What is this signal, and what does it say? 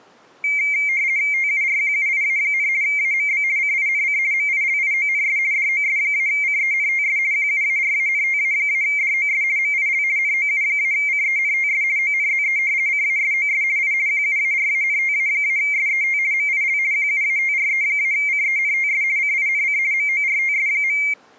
RTTY (50 baud, 170 Hz shift), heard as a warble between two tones, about 2200 Hz centre. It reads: TURQUIA, AMB CINC MILIONS DOS-CENTS QUARANTA-DOS MIL NOU-CENTS ONZE CASOS I QUARANTA-SET MIL QUATRE-CENTS CINC MORTS.